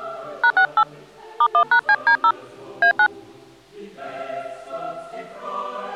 DTMF, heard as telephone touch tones, dialled by hand, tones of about 70 ms. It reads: #68 *1#CD0 A9